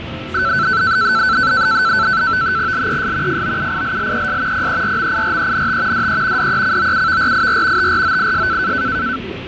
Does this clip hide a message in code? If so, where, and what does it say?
Yes: NAVTEX (SITOR-B), 100 baud, 170 Hz shift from 0.3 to 9.2 s, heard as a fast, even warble, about 1420 Hz centre, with radio static, fading and the noise of a cafe. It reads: LES FOUILLES PERMIRENT DE DECOUVRIR TROIS